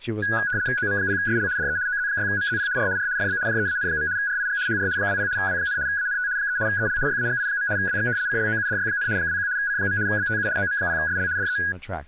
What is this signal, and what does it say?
RTTY (75 baud, 170 Hz shift), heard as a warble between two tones, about 1550 Hz centre, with speech in English. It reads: OM0SL DE OZ6MZP R R FB JEAN. RIG HR 20 W, ANT 3 EL YAGI. WX CLOUDY, 21 C. BTU OM0SL DE